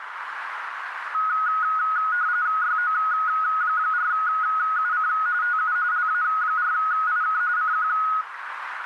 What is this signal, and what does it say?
RTTY (45.45 baud, 170 Hz shift), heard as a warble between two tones, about 1360 Hz centre, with radio static and a narrow filter. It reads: YO4UC TU LA4IK CQ